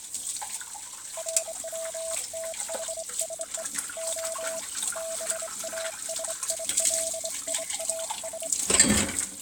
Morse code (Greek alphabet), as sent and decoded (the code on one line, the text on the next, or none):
.-. .-- - .... ... . / --- / -... .- ... .. .-.. .. .- ...
ΡΩΤΗΣΕ Ο ΒΑΣΙΛΙΑΣ